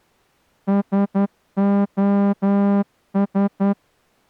Morse code, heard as a horn, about 11 wpm. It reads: SOS